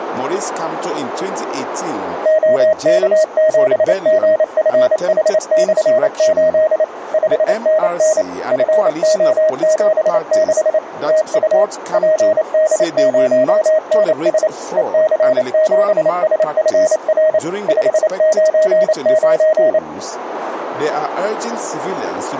Morse code, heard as a keyed tone, machine-sent, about 28 wpm, 630 Hz, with radio static. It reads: OK7GFH/8 5NN FO76 TU PD0NS EC7SFR 599